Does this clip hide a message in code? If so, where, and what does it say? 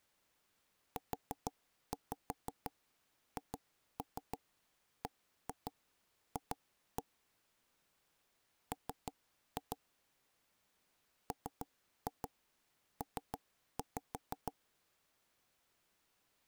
Yes: tap code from 1.0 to 14.5 s, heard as knocks on wood, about 6 knocks a second. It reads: UHBF M MP